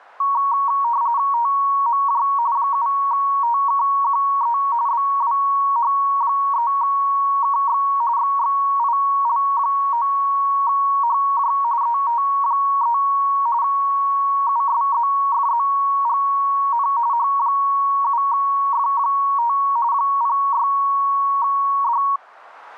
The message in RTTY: TMJ 7TKQE BWH3KX XXIL9HJ ET3 USZFZGN H7F5 06D

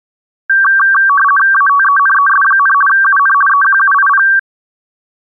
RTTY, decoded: ATENES, UN EQUIP

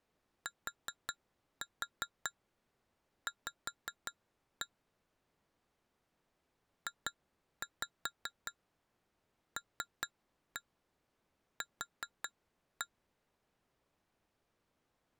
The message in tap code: TV JLQ

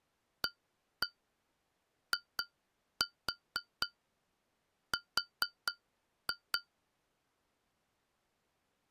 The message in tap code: AIR

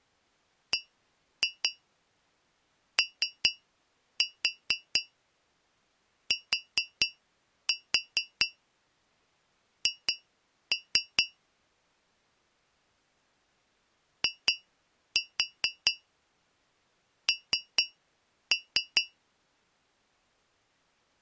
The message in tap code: BOTH IN

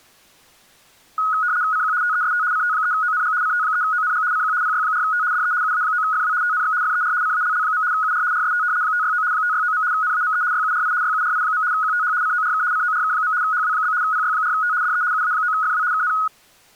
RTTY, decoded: CQ TEST CT3ONG CT3ONG CQ PY4T DE UA9FW TNX FER CALL. UR RST 569 569. NAME YURI YURI. QTH CORK CORK. HW? PY4T DE UA9FW KN

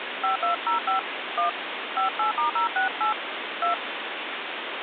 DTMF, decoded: 5205 1 58*068 2

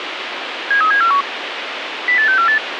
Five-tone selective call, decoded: 73741 08648

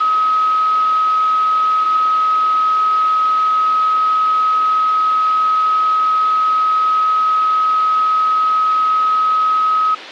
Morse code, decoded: none

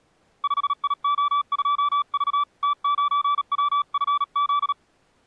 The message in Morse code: 5IO2V T9WFZ

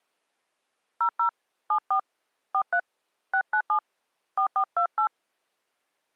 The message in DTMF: 00 74 43 697 4428

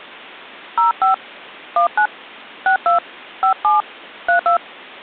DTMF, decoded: 05 19 62 57 32

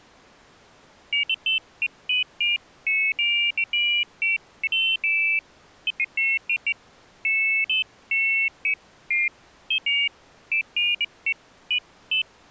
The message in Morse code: none

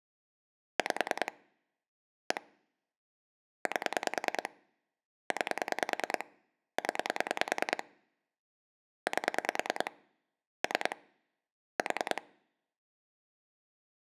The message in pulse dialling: 5 1 8 9 0 8 3 4

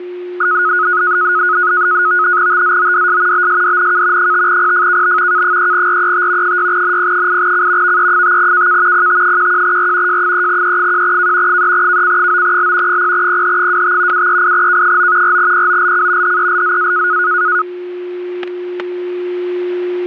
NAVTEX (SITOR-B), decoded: TZODS BSDNK 5PFKB K3RET 6NP8C VE5KK PT11R J3E1K 3KC9L 0PH25 738K9 4POLC HELZA

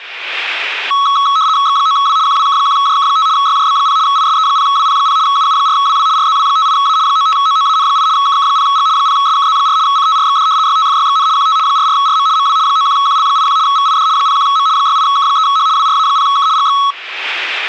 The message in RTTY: X9W QWK1JK5 YJB0 ISE0WP0 UU4WW RZW58A 95OOAN8 KK0G 0SKZ4 CTRXD YTFYXN QT 44RM MW 91QL81 VID 01M 68K3H WRA0K GX

